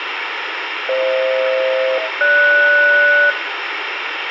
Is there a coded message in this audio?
Yes: aircraft SELCAL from 0.9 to 3.3 s, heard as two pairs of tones, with radio hiss and room echo. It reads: FH-GS